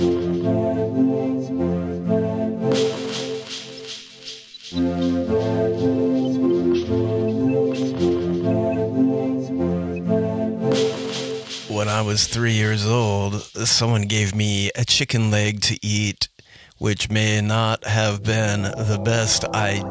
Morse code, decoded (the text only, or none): none